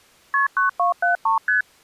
Multi-frequency trunk signalling (R1, as on North American trunks), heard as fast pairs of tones, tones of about 130 ms. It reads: KP 9273 ST